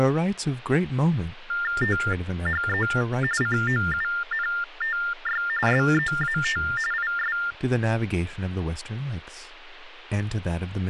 TTY/TDD text telephone tones (45.45 baud Baudot), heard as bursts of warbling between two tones, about 400 Hz shift, 1600 Hz centre, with speech in English. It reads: THE COUNTY SEAT IS